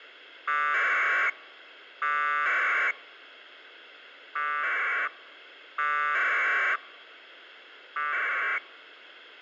Packet radio (AX.25, as in APRS), 1200 baud, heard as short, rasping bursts.